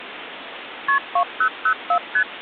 Multi-frequency trunk signalling (R1, as on North American trunks), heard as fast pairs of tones, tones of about 80 ms, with phone line noise. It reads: KP 2004 ST